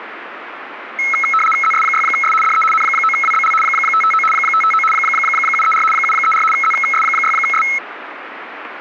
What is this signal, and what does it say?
RTTY (75 baud, 850 Hz shift), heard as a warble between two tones, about 1750 Hz centre, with radio static. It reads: ZS6S DE N9WBL 559 559 734 734 ZS6S